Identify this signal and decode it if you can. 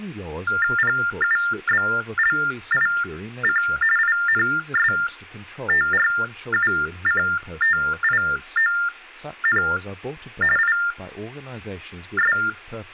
TTY/TDD text telephone tones (45.45 baud Baudot), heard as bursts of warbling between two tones, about 400 Hz shift, 1600 Hz centre, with speech in English. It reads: PUBLIC INSTRUCTION IS